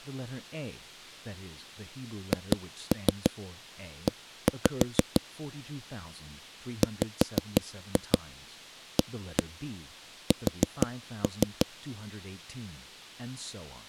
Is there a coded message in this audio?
Yes: tap code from 2.3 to 11.7 s, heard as knocks on a wall, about 6 knocks a second, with speech in English. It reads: HE WAS